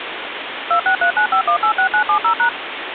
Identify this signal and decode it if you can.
DTMF, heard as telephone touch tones, dialled by machine, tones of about 90 ms, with phone line noise. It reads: 26395186970#